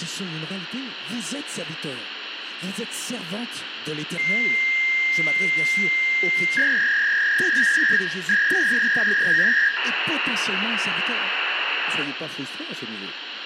Fax machine handshake, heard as a long tone, a warble and hiss, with phone line noise and room echo.